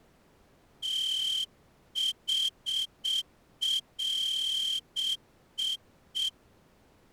Morse code, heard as a whistle, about 7 wpm. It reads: THREE